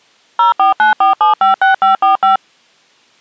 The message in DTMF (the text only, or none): 0494756545